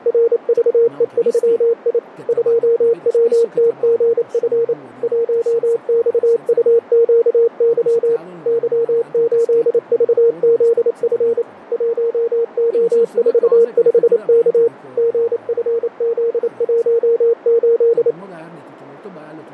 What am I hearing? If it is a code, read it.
Morse code, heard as a keyed tone, machine-sent, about 28 wpm, 460 Hz, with radio static and speech in Italian. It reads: RVE3I 2WTGF 1XUQY Y8VZF 1O45K GFZ18